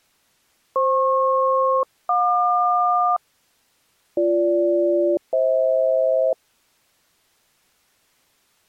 Aircraft SELCAL, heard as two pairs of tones. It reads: FP-JQ BG-FH